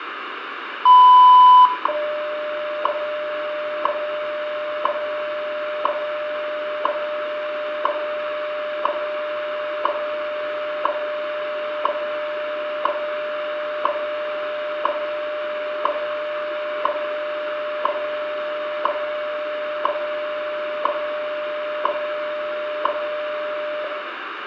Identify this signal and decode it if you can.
Radio time signal (WWV, Colorado), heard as ticks, one a second, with radio static, a steady whistle near 1980 Hz and room echo.